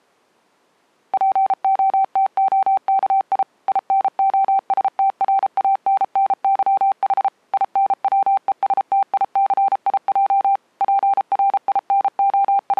Morse code (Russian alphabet), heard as a keyed tone, machine-sent, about 33 wpm, 780 Hz. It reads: ПОТОКИ ИНОСТРАННЫХ ИНВЕСТИЦИЙ …